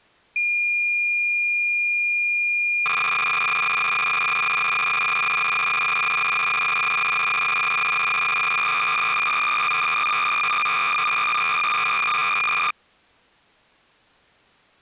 Cassette data (Kansas City type), 300 baud, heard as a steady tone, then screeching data.